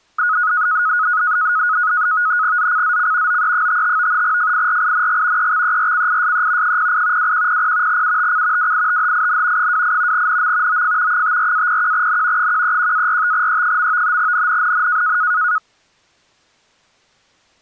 NAVTEX (SITOR-B), 100 baud, 170 Hz shift, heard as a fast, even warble, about 1360 Hz centre. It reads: ZCZC OE55 FIRING EXERCISE 08 2100 UTC WITHIN 28 NM OF 54-01N 131-45E. NNNN